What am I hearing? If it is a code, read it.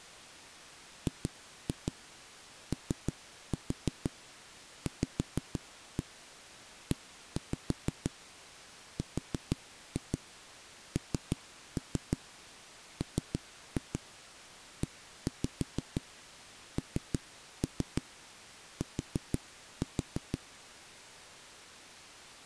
Tap code, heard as knocks on a wall, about 6 knocks a second. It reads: GOVERNMENT